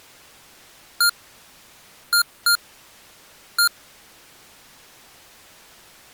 Beep code, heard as beeps from a small speaker, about 1400 Hz. 1-2-1. In Phoenix BIOS tables: interval timer failure.